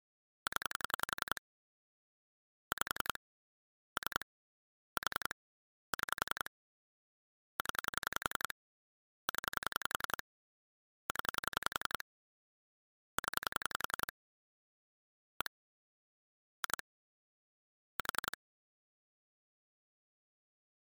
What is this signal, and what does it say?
Pulse dialling, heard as clicks on a phone line, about 11 pulses a second. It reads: 0 5 3 4 6 0 0 0 0 1 2 4